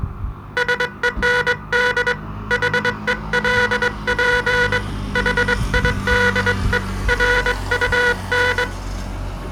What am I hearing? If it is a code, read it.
Morse code, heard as a buzzer, hand-sent with a straight key, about 22 wpm, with street noise. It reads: SEND HELP HIDE RUN